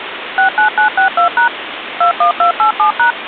DTMF, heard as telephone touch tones, dialled by machine, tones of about 110 ms, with phone line noise. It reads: 69962# 21287#